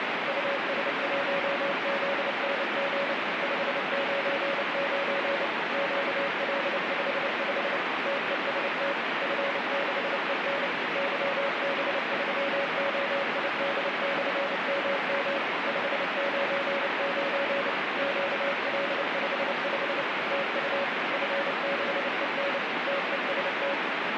Morse code, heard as a keyed tone, machine-sent, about 29 wpm, 560 Hz, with heavy radio static. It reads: US1ZNG 599 QL55 TEST F6EN YB3OID/MM 599 QL55 TU F6EN TEST